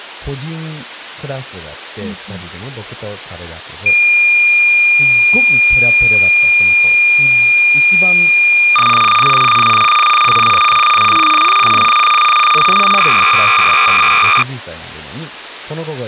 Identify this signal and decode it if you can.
Cassette data (Kansas City type), 300 baud, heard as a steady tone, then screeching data, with speech in Japanese.